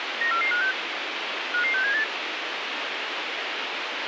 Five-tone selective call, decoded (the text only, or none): 94456 55678